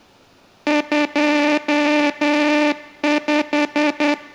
Morse code, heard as a buzzer, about 10 wpm. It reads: 25